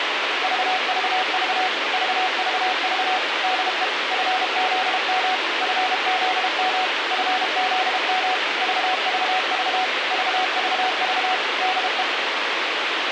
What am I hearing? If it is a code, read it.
Morse code, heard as a keyed tone, machine-sent, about 32 wpm, 740 Hz, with radio hiss. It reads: VVV VVV DE FZM FZM FZM VVV VVV DE